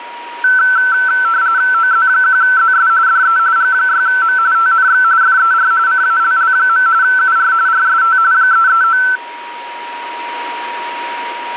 RTTY (45.45 baud, 170 Hz shift), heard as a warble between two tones, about 1430 Hz centre, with a steady whistle near 950 Hz. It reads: OZ1ZS DE G6M TNX FER CALL. UR RST 339